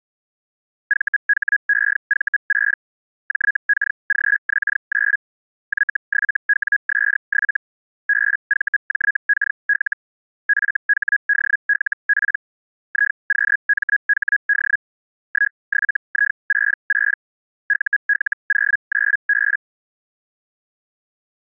Hellschreiber (Feld-Hell, 122.5 baud), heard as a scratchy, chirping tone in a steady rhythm, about 1650 Hz. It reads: VHEV6 JKGX9 Y7WS7 BVJKL FHDLP IQMHD 17I66 UL09B